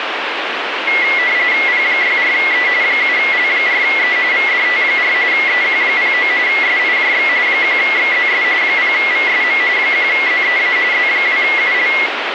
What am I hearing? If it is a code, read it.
RTTY (45.45 baud, 170 Hz shift), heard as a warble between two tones, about 2050 Hz centre, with radio static. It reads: P64E 7L4E VDT4 EQ09 SIJX 1XZS 0VSM 1ZEA Z2UL